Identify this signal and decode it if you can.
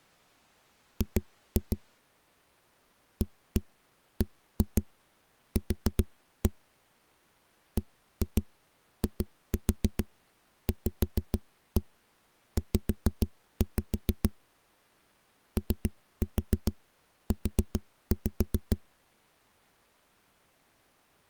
Tap code, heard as knocks on a wall, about 7 knocks a second. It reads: G ABQ BIVZ OU